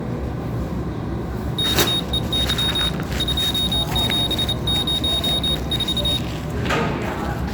Morse code, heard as a high beeper, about 28 wpm, 3750 Hz, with room echo and the noise of a restroom. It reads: KEY 2704